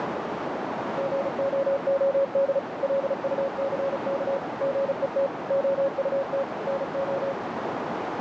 Morse code, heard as a keyed tone, machine-sent, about 35 wpm, 550 Hz, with heavy radio static and a narrow filter. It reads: GOOD LUCK GET OUT NO